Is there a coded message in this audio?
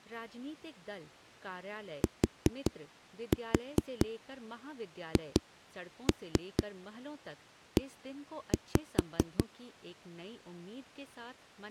Yes: tap code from 2.0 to 9.4 s, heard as knocks on a wall, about 4 knocks a second, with speech in Hindi. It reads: THE